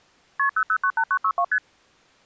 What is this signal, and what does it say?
Multi-frequency trunk signalling (R1, as on North American trunks), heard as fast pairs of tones, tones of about 70 ms. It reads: KP 0098962 ST